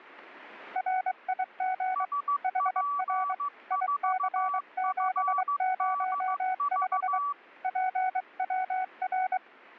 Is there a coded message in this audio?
Yes: Morse code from 0.7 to 9.4 s, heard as two keyed tones. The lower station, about 23 wpm, 750 Hz: RIG HR IC705 PWR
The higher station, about 15 wpm, 1150 Hz: SP4FDV